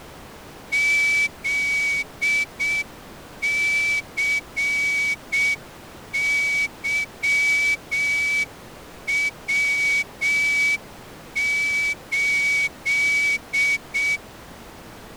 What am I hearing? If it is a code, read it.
Morse code, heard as a whistle, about 6 wpm. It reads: ZCYW8